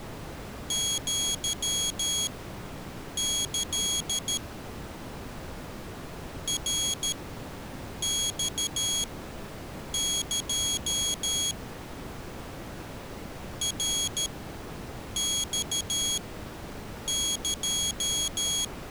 Morse code (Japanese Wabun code), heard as a high beeper, machine-sent, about 13 wpm, spaced as for 7 wpm, 3300 Hz. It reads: アキ ナマエ ナマエ